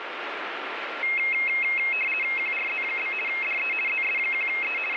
RTTY (50 baud, 450 Hz shift), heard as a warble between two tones, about 2350 Hz centre, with radio static. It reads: QRZ? DE ZS1E …